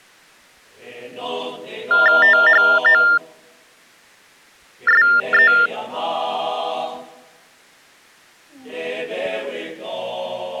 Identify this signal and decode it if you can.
TTY/TDD text telephone tones (45.45 baud Baudot), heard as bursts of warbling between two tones, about 400 Hz shift, 1600 Hz centre. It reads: THOSE